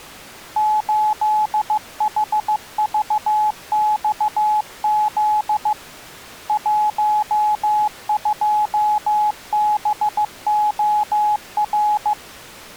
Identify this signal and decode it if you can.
Morse code, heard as a keyed tone, hand-sent with a paddle, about 15 wpm, 850 Hz. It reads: 8HVXZ 12BOR